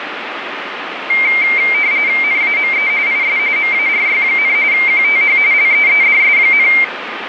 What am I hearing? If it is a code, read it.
RTTY (45.45 baud, 170 Hz shift), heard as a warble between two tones, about 2200 Hz centre, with radio static. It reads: NAME IS MARY, QTH LEEDS,